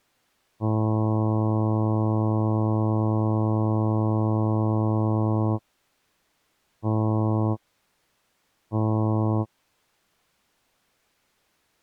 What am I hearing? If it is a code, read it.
Ship horn signal, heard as a ship's horn, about 110 Hz. 1 long, 2 short. At sea: a vessel in fog that is sailing, fishing, towing or hampered.